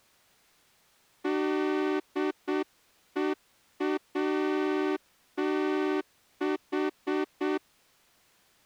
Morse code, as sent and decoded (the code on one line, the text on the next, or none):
-.. . .- - ....
DEATH